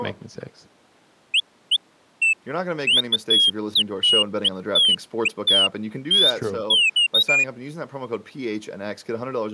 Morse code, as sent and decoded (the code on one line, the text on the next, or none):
none